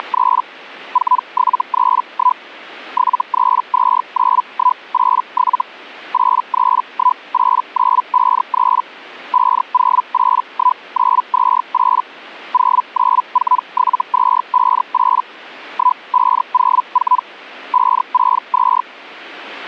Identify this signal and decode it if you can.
Hellschreiber (Feld-Hell, 122.5 baud), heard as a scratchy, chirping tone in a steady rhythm, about 1000 Hz. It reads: … 4731 7329187 8318953 5081928 0947258 1504 562